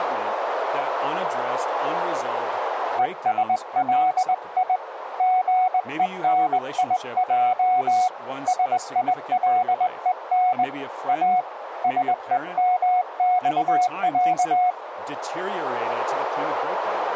Morse code (Russian alphabet), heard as a keyed tone, hand-sent with a straight key, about 20 wpm, 740 Hz, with radio static and speech in English. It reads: ЕСЛИ ГЕНИЙ СИЛЕН А СЕМЬЯ